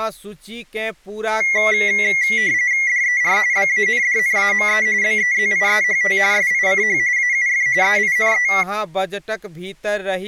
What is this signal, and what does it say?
RTTY (45.45 baud, 170 Hz shift), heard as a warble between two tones, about 2050 Hz centre, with speech in Maithili. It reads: DER BANDNAME BEZIEHT SICH AUF EINE